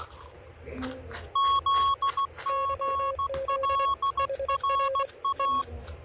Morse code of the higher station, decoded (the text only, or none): ZGLRA